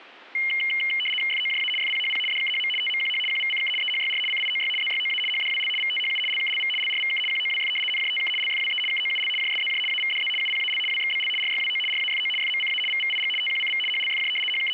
RTTY (75 baud, 850 Hz shift), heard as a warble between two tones, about 2550 Hz centre, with static crashes. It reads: FOJA FPHP DKHM TMQH QVCK EHYR CIOY ZYOA HDWL VTHU LKLV LRVK QOWF NJTK LFWE KOUL JSZJ AVDZ UPAL WXBL RYWO RAFO FMCA VVIG TQCV HLFJ …